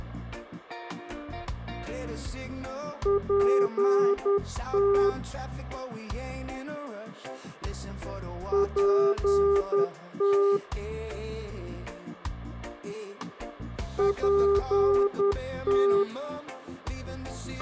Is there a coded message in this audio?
Yes: Morse code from 3.0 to 16.1 s, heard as a keyed tone, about 10 wpm, 400 Hz, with a squelch burst at the end. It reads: PT PT PT